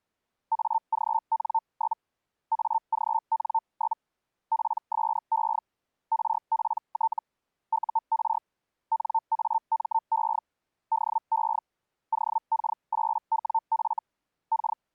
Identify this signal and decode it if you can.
Hellschreiber (Feld-Hell, 122.5 baud), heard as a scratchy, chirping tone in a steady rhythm, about 900 Hz. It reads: AGN? AGN? PSE RPT UR NAME DE OK8WF K